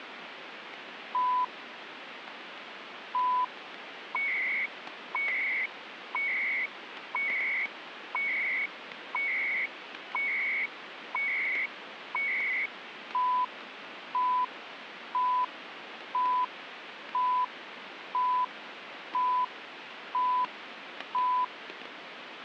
Radio time signal (CHU, Canada), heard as beeps and data bursts, one a second, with radio static and static crashes.